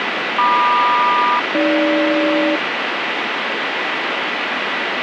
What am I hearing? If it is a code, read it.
Aircraft SELCAL, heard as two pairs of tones, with heavy radio static. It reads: MQ-AG